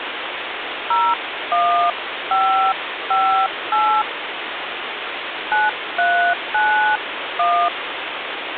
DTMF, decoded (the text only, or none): 01558 9391